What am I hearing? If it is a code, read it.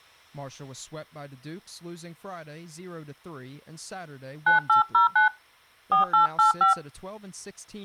DTMF, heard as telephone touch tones, dialled by hand, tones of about 130 ms, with speech in English. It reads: 9809 4885